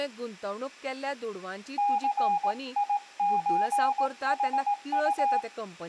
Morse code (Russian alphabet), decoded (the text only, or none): ЦИЧХУ